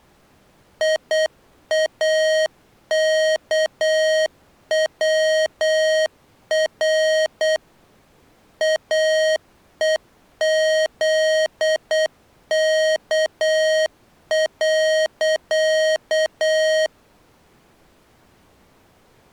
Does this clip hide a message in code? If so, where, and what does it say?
Yes: Morse code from 0.8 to 16.9 s, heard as electronic beeps, machine-sent, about 8 wpm, 630 Hz. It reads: IAKWR AEZK.